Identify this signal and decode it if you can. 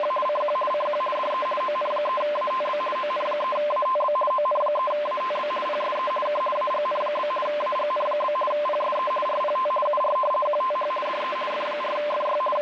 RTTY (50 baud, 450 Hz shift), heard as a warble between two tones, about 820 Hz centre, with radio static. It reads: … CQ CQ DE ON3ATB ON3ATB ON3ATB PSE K AGN? AGN? PSE RPT UR QTH DE F4FY …